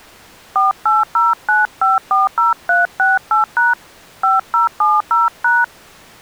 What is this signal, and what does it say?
DTMF, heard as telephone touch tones, dialled by hand, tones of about 170 ms. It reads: 4809540368# 5070#